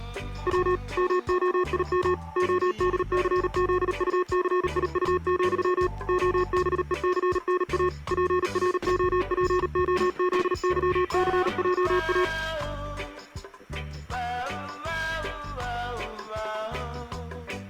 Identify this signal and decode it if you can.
Morse code, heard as electronic beeps, machine-sent, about 38 wpm, 360 Hz. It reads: W MOIM ODCZUCIU, OBECNA PROPOZYCJA